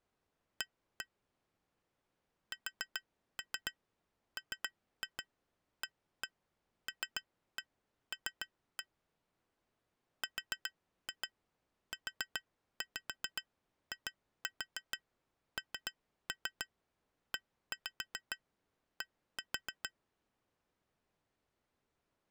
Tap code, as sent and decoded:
1-1 / 4-3 3-2 1-1 3-1 3-1 / 4-2 4-5 2-4 3-3 1-5 1-4
A SMALL RUINED

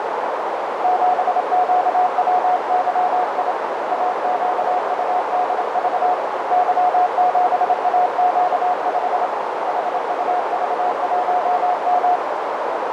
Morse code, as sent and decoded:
--... --.- .-- -.-- .. / .- --.- ..- -.. ...- / -.-- --... .- --.- ..... / .... ..- ...- .---- --
7QWYI AQUDV Y7AQ5 HUV1M

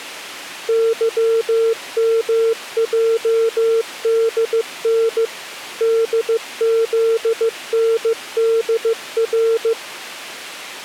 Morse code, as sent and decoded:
-.-- -- .--- -.. -. / -.. --.. -. -.. .-.
YMJDN DZNDR

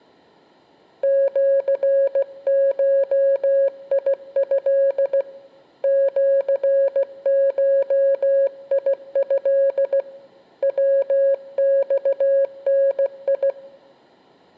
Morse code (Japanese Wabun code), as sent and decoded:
--.-. ---- .. ..-.. / --.-. ---- .. ..-.. / .-- -..- -. ..
シゴト シゴト ヤマダ

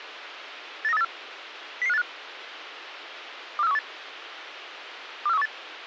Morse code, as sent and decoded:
none

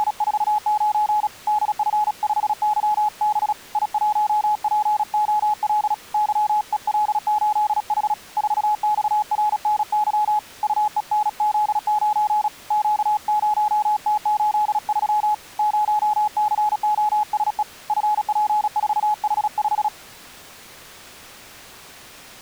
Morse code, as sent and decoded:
… / -.. ..-. ..... -.-- -... / .. .---- .--. --- .-.. / -.-- . .-.. ---.. .... / ....- -..- .-. -. -.-- / ..- . -. --.. ----. / --.- ----- - ---.. ...-- / ----- -.-. --- ... . / ..-. .--. ....- .... .....
… DF5YB I1POL YEL8H 4XRNY UENZ9 Q0T83 0COSE FP4H5

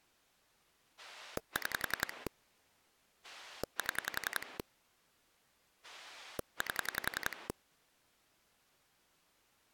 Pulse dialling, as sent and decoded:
6 / 7 / 8
6 7 8

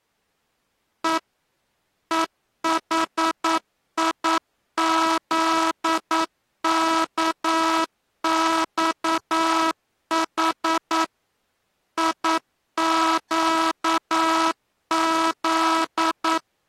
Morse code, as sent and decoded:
. / . .... .. --.. -.- -..- .... / .. --.- --..
E EHIZKXH IQZ

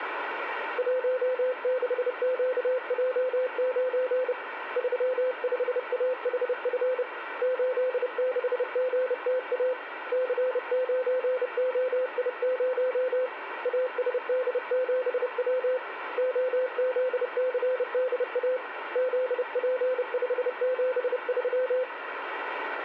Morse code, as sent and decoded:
.---- -.... --.- .--- ----. / ...-- ..... .- .... ..-. / ---.. -.... --. - .- / -.-. ----. --- .. ----- / .- ... -.. --... .-- / --- --.. -.-. -.. .- / --.. .--. ..... --... ...--
16QJ9 35AHF 86GTA C9OI0 ASD7W OZCDA ZP573

